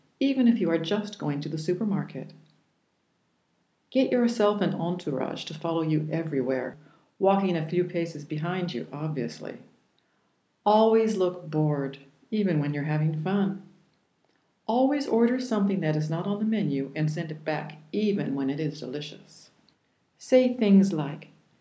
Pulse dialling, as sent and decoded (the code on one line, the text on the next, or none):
none